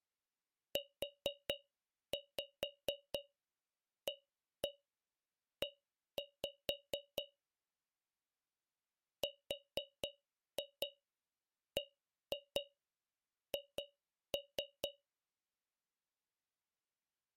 Tap code, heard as taps on a metal pipe, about 4 knocks a second. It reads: UAE RBH